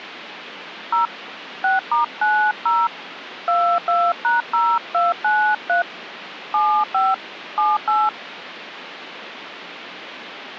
DTMF, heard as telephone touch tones, dialled by hand, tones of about 210 ms, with phone line noise. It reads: 0 6*90 22#0293 75 78